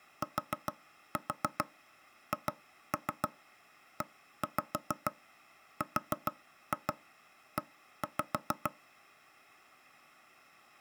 Tap code, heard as knocks on wood, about 6 knocks a second. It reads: THERE